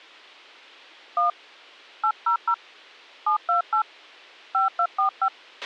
DTMF, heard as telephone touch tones, dialled by hand, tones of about 120 ms, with a squelch burst at the end. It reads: 1 800 728 5245